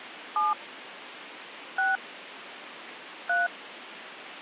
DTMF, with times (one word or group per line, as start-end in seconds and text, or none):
0.4-0.5 7
1.8-2.0 6
3.3-3.5 3